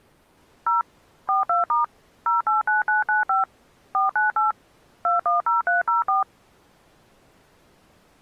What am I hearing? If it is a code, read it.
DTMF, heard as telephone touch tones, dialled by machine, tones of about 140 ms. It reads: 0 42* 089995 498 210304